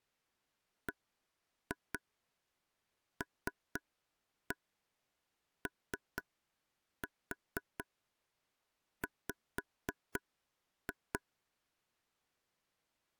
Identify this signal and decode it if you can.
Tap code, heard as taps on a table, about 4 knocks a second. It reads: BLOW